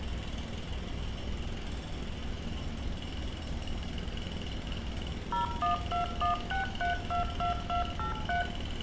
DTMF, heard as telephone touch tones, dialled by machine, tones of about 130 ms, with room echo and street noise. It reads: 01216322283